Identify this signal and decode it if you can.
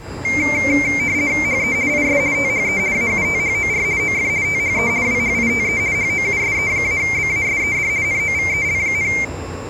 RTTY (50 baud, 170 Hz shift), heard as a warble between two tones, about 2200 Hz centre, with the noise of a subway station. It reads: HE IS THE AUTHOR OF THE WHITE HOUSE-BASED NOVEL,